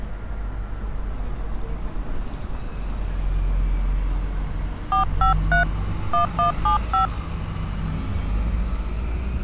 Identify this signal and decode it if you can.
DTMF, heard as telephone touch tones, dialled by hand, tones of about 120 ms, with street noise. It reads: 453 1175